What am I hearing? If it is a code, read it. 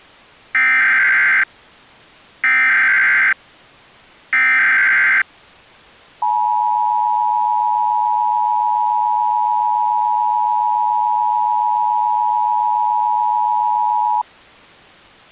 Emergency Alert System (SAME) tones (header bursts, then the 853 and 960 Hz attention tone), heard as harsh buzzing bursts, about 520.83 baud.